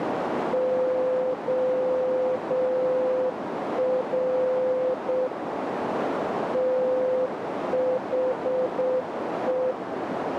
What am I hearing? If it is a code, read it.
Morse code, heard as a keyed tone, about 7 wpm, 510 Hz, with radio static and a narrow filter. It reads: OR THE